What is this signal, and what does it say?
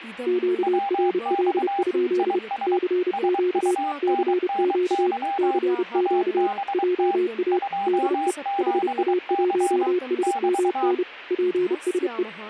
Morse code, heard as two keyed tones, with speech in Sanskrit. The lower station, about 30 wpm, 360 Hz: QRL? CQ CQ CQ JA DE HA1SMN PSE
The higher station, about 23 wpm, 800 Hz: WX IS SUNNY ABT 27C <BT>